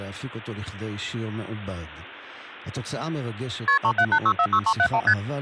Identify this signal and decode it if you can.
Multi-frequency trunk signalling (R1, as on North American trunks), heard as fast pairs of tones, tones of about 70 ms, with speech in Hebrew. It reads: KP 378646371 ST